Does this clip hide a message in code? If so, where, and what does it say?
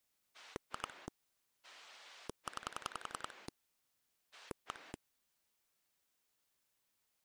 Yes: pulse dialling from 0.3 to 5.0 s, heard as a rotary dial, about 10 pulses a second. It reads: 2 9 1